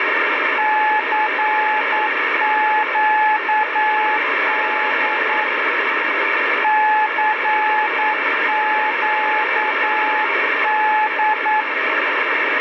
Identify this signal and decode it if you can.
Morse code, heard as a keyed tone, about 9 wpm, 860 Hz, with heavy radio static. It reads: CQD CQD